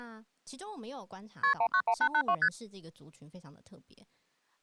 Multi-frequency trunk signalling (R1, as on North American trunks), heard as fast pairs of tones, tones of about 70 ms, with speech in Chinese. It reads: KP 191882 ST